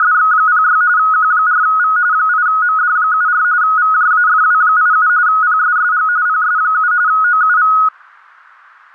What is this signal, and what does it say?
RTTY (45.45 baud, 170 Hz shift), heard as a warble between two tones, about 1360 Hz centre. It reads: … Q4V 8MD74 VJAFW87 PSSG PS7 OUV